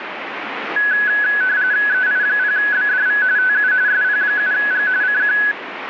RTTY (45.45 baud, 170 Hz shift), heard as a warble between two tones, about 1600 Hz centre, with radio static. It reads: EI0BDV TU SP7G CQ